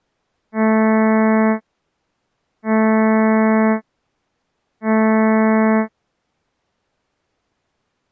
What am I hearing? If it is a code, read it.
Ship horn signal, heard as a ship's horn, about 220 Hz. 3 short. At sea: I am operating astern propulsion.